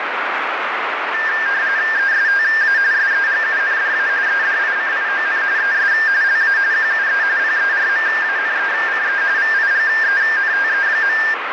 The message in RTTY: ESTA SEGUNDA EDICION ES LA QUE PERMANECE VIGENTE.

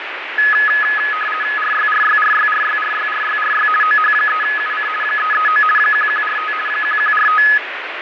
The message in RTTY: RYRYRYRYRYRYRY OH3UC 339 1145 1145

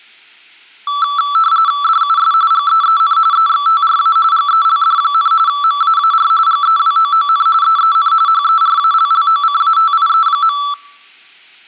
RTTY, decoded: DUS GEEN EXTRA GELD, MAAR GEWOON EEN HERALLOCATIE.

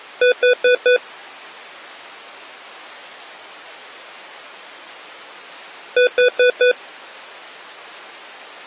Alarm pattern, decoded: temporal four

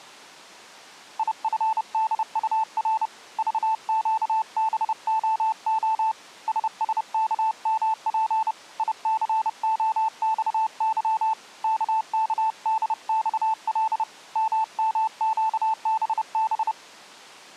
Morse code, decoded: IFDUR VQBOO SSKMP ICOXY KKDXL MMQBB

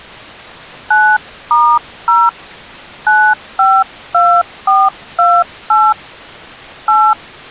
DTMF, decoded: 9*0 952428 8

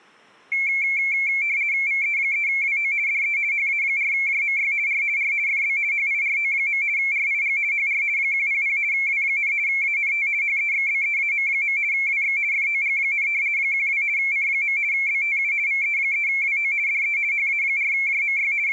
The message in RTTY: VE3WO DE HA4JMY R R FB HIRO. RIG HR 100 W, ANT HEXBEAM. WX FOG, 12 C. BTU VE3WO DE HA4JMY …

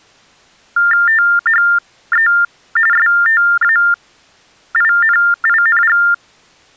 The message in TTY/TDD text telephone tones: THE STAINING

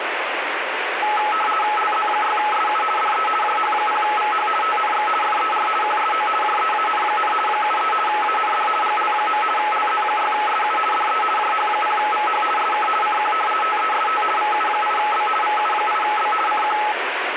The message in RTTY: LZ6SU DE JH0VH TNX FER QSO JEAN, 73 AND GL. LZ6SU DE JH0VH SK CQ TEST VU8B VU8B CQ

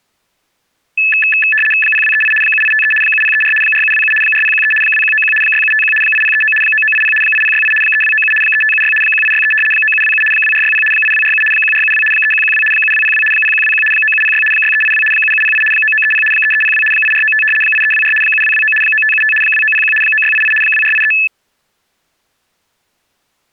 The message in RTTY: 0238 7853 7034 4727 4013 2191 6751 8039 9980 8068 3297 3576 1863 9727 2460 8247 1472 3112 7202 0121 9706 6382 7708 9930 3302 8495 8324 7229 9575 2901 9688 2483

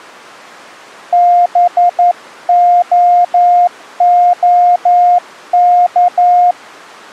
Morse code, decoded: BOOK

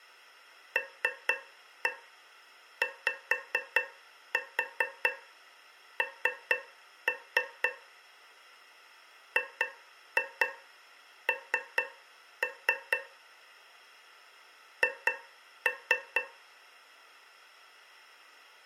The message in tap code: LYN GN H

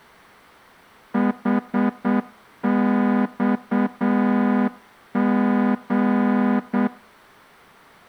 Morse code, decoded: HXG

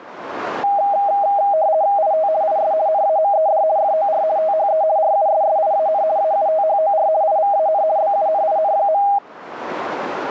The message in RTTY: IT IS NAMED FOR THE RUSSIAN AUTHOR IVAN BUNIN.

